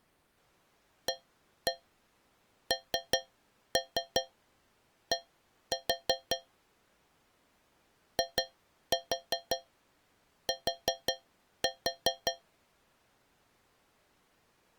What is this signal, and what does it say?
Tap code, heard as taps on a metal pipe, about 5 knocks a second. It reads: AND IT